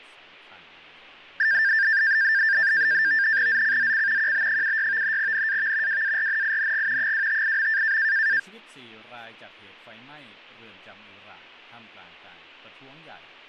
NAVTEX (SITOR-B), 100 baud, 170 Hz shift, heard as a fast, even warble, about 1700 Hz centre. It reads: ZCZC QB76 NAV WARNING 258.